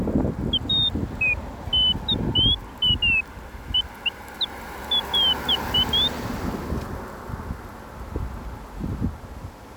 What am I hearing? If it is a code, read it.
Bird-like chirps, with street noise. There is no code.